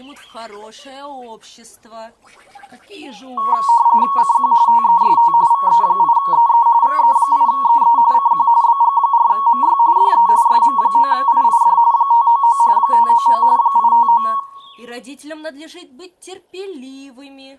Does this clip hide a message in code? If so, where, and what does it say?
Yes: RTTY (45.45 baud, 170 Hz shift) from 3.4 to 14.4 s, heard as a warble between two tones, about 1020 Hz centre. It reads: CQ TEST VE8EE VE8EE CQ BG4MY DE SM9IID 599 599 859